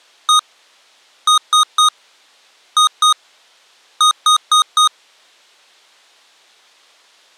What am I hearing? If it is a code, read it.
Beep code, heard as beeps from a small speaker, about 1240 Hz. 1-3-2-4.